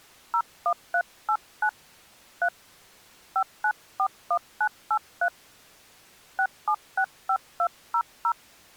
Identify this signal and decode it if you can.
DTMF, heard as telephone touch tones, dialled by hand, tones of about 70 ms. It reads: 01389 3 5941983 6765200